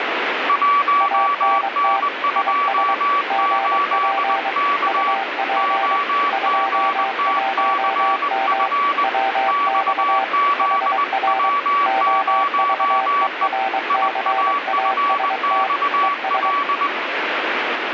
Morse code, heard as two keyed tones, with radio static. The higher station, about 20 wpm, 1140 Hz: 1N28K OGTCF XZW0E IAFXL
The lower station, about 23 wpm, 780 Hz: ANT IS GP UP 21M WX HR OVERCAST ES